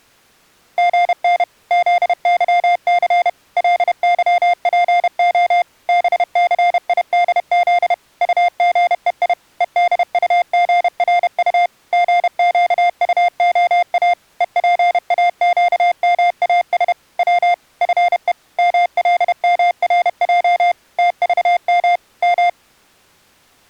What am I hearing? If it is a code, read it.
Morse code, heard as electronic beeps, machine-sent, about 31 wpm, 700 Hz. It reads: GN ZYC LYPO BCIDZ UGEI EDUGRU GQUOA EPAQMAS W FE MLMRJ TVM M